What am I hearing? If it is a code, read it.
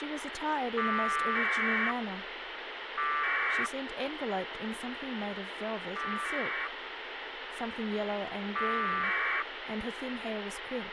Packet radio (AX.25, as in APRS), 1200 baud, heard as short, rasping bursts, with radio hiss and speech in English.